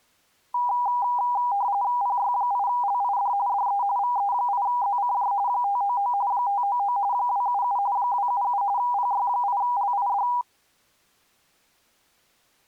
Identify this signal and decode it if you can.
RTTY (45.45 baud, 170 Hz shift), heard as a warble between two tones, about 890 Hz centre. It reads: PY8LID DE VE8ZCJ 599 599 277 277 PY8LID